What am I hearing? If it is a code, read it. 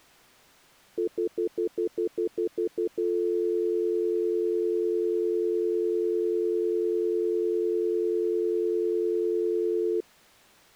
Telephone call progress tone (North American plan), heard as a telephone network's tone, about 350, 440 Hz, 0.1 s on and 0.1 s off. Stutter dial tone.